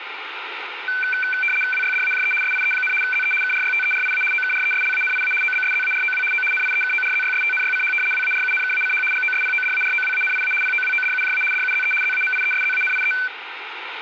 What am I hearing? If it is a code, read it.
RTTY (75 baud, 850 Hz shift), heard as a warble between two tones, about 1950 Hz centre, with radio static and room echo. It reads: WYDAJE SIE, ZE KRYTERIA OKRESLANIA OBSZAROW O NIEKORZYSTNYCH WARUNKACH GOSPODAROWANIA POWODUJA DUZE ZAMIESZANIE